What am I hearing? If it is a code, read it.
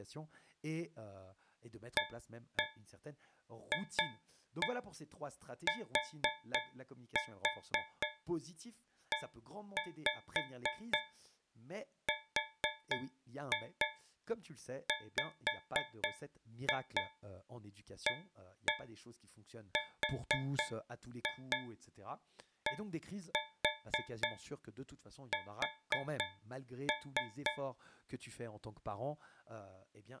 Tap code, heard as taps on a metal pipe, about 4 knocks a second, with speech in French. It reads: AFTERWARDS